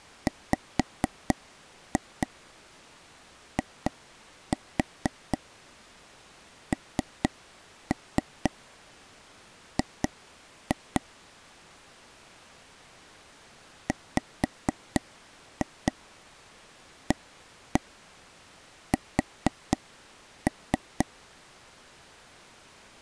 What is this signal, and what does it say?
Tap code, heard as taps on a table, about 4 knocks a second. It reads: WING WAS